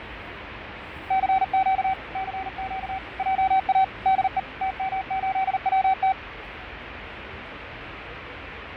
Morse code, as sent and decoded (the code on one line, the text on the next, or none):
-.-. --.- / -.-. --.- / .--- .- / -.. . / - -- ---.. .-- -
CQ CQ JA DE TM8WT